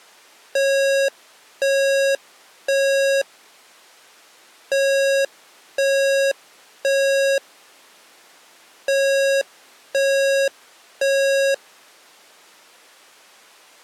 Alarm pattern, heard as an alarm's beeps, played three times, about 550 Hz. Temporal three. Smoke or fire, evacuate.